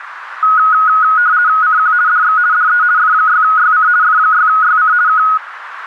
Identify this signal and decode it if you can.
RTTY (50 baud, 170 Hz shift), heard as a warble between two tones, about 1360 Hz centre, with radio static and a narrow filter. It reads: CQ DX DE F6YC F6YC K